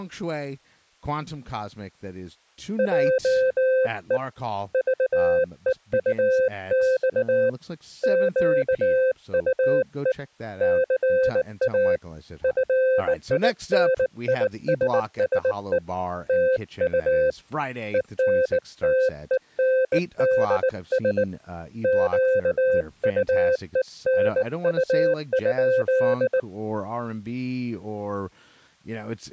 Morse code, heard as a keyed tone, hand-sent with a bug key, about 19 wpm, 520 Hz, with speech in English. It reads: JE VEUX QUE CA FINISSE TU ENTENDS QUENU?